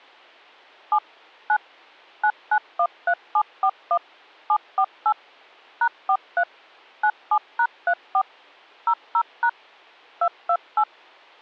DTMF, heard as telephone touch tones, dialled by machine, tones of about 70 ms. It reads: 7 9 9913741 748 #43 97#34 00# 228